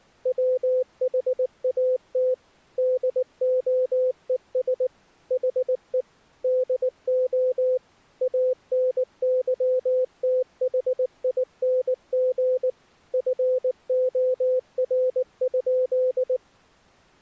Morse code, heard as a keyed tone, machine-sent, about 19 wpm, 510 Hz. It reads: WHAT DOES HE DO ANYTHING FOR?